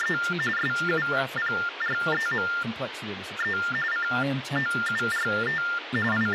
TTY/TDD text telephone tones (45.45 baud Baudot), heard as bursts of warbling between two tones, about 400 Hz shift, 1600 Hz centre, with phone line noise and speech in English. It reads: … SUPREME COURT …